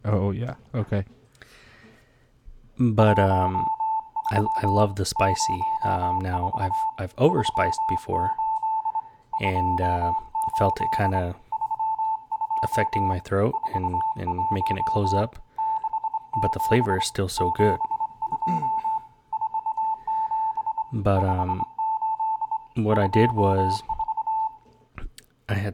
Morse code, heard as a keyed tone, hand-sent with a straight key, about 25 wpm, 880 Hz, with room echo and speech in English. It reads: 13 04 38 28 32 41 67 72 47 58 24